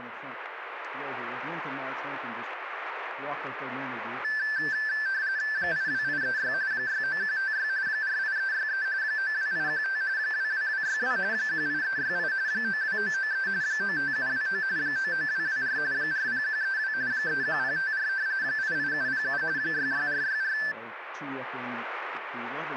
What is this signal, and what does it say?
RTTY (45.45 baud, 170 Hz shift), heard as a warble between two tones, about 1650 Hz centre, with radio static. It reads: 82836 69156 48363 92815 22262 18368 92993 95729 99224 40132 31054 88707 66464